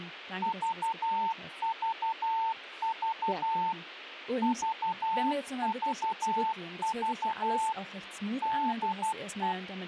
Morse code, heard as a keyed tone, machine-sent, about 12 wpm, 890 Hz, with a squelch burst at the end and speech in German. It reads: VVV VVV DE